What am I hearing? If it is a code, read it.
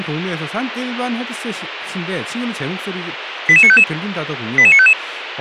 Five-tone selective call (ZVEI), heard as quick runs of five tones, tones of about 70 ms, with radio hiss and speech in Korean. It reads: 88955 88955